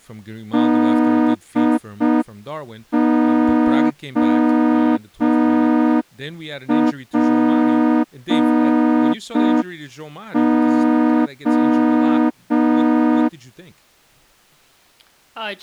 Morse code, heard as a horn, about 5 wpm, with speech in English. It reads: DOPO